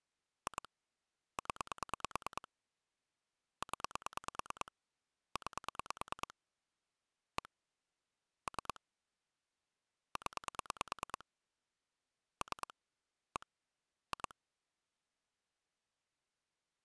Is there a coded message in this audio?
Yes: pulse dialling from 0.5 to 14.3 s, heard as clicks on a phone line, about 9 pulses a second. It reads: 2 0 0 9 1 3 0 3 1 2